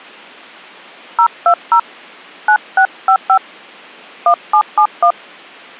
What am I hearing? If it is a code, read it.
DTMF, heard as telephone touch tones, dialled by hand, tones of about 80 ms. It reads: 020 9655 1771